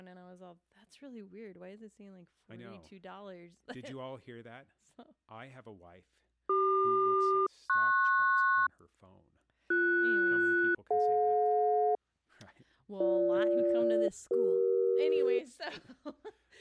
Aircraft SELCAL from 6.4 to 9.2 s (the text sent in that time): CQ-PS